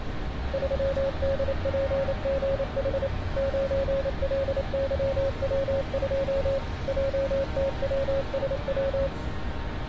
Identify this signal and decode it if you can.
Morse code, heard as a keyed tone, machine-sent, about 28 wpm, 550 Hz, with street noise. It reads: 3DPGH 9LYW2 JTWSW